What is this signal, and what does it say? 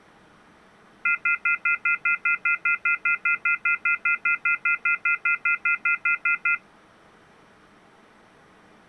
Telephone call progress tone (North American plan), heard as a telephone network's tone, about 1400, 2050, 2450, 2600 Hz, 0.1 s on and 0.1 s off. Off-hook warning tone.